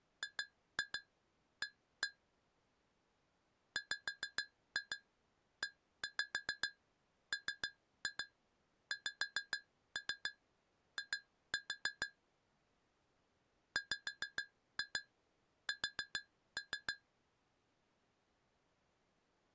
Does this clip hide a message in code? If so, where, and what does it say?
Yes: tap code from 0.2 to 17.0 s, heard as taps on glass, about 6 knocks a second. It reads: GA WEMXI WS